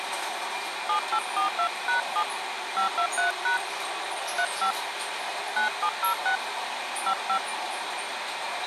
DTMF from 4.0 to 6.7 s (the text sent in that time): 35 9706